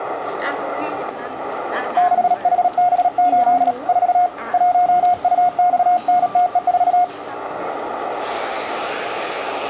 Morse code, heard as a keyed tone, hand-sent with a paddle, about 37 wpm, 720 Hz, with the noise of a cafe. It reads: 6HB8 4 1UXNTE4